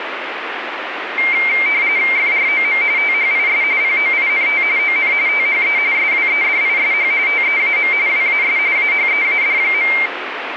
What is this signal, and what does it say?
RTTY (45.45 baud, 170 Hz shift), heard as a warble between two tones, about 2200 Hz centre, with radio static. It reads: FROM THIS POINT ON THE SWEDISH TEAM WAS AHEAD.